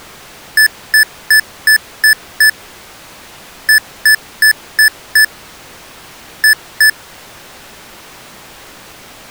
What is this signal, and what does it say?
Beep code, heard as beeps from a small speaker, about 1750 Hz. 6-5-2.